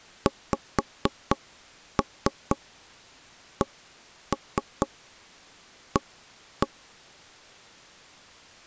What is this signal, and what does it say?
Tap code, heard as taps on a table, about 4 knocks a second. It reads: XCA